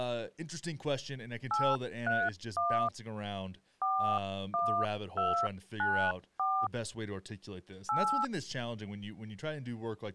DTMF, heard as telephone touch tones, dialled by hand, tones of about 290 ms, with speech in English. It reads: 831 41294 8